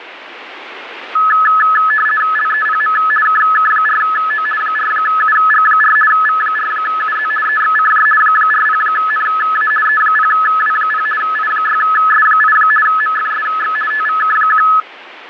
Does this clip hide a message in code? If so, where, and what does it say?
Yes: RTTY (50 baud, 450 Hz shift) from 1.2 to 14.8 s, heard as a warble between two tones, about 1500 Hz centre, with radio static. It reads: LEPM KK4O 4UG4 V4UZ EXCJ 40NA E0W0 I6S8 MFSX TVK1